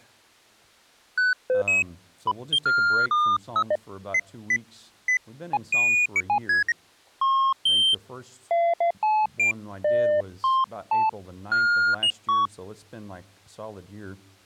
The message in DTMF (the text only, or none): none